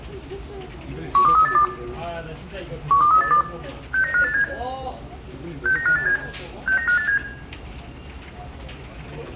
Five-tone selective call (CCIR), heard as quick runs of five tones, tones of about 100 ms, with room echo and the noise of a crowd indoors. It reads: 12382 12382 69587 69587 69587